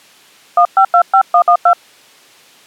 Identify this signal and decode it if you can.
DTMF, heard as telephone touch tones, dialled by hand, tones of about 80 ms. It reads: 1525112